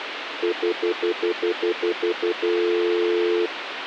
Telephone call progress tone (North American plan), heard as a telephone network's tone, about 350, 440 Hz, 0.1 s on and 0.1 s off, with phone line noise. Stutter dial tone.